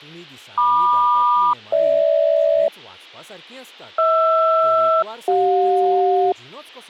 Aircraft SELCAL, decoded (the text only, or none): MQ-GH HR-CJ